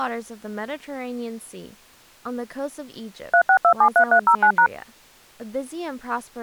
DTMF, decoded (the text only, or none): 36273309#